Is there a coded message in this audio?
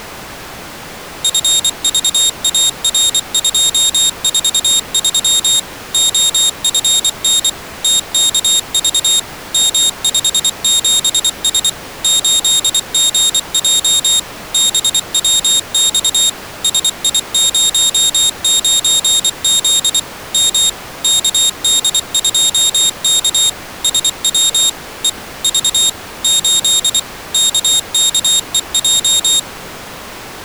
Yes: Morse code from 1.2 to 29.5 s, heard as a high beeper, machine-sent, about 24 wpm, 3700 Hz. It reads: FVAR243 OFN TKV M57S 8GJ BWX SI09Z M KD2K SW E V 8 KKEJ